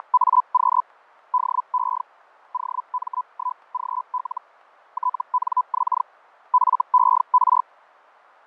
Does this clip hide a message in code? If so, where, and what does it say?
Yes: Hellschreiber (Feld-Hell, 122.5 baud) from 0.0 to 7.6 s, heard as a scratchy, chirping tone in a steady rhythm, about 1000 Hz, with fading. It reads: … DE OM1GL TNX FER